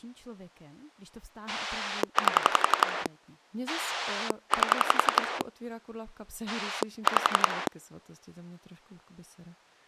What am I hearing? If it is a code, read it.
Pulse dialling, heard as a rotary dial, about 11 pulses a second, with speech in Czech. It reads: 8 8 5